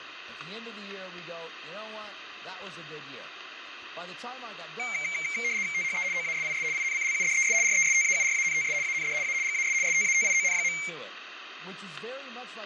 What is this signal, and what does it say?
RTTY (75 baud, 170 Hz shift), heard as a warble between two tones, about 2200 Hz centre, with room echo. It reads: THE OASIS INCLUDES RESTAURANTS AND A GAS STATION.